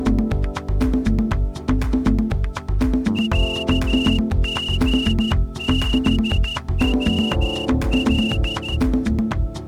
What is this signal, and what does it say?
Morse code (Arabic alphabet), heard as a whistle, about 13 wpm. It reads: عغبول